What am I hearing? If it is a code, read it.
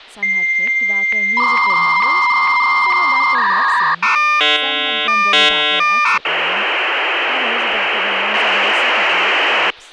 Dial-up modem handshake (V.34 or later), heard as a whistle, warbles, then hiss, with speech in English.